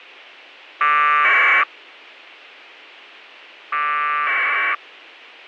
Packet radio (AX.25, as in APRS), 1200 baud, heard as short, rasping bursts.